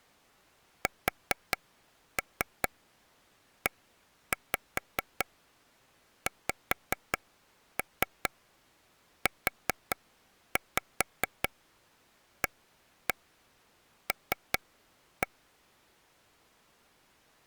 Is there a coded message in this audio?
Yes: tap code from 0.9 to 15.3 s, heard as taps on a table, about 4 knocks a second. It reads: SEXUAL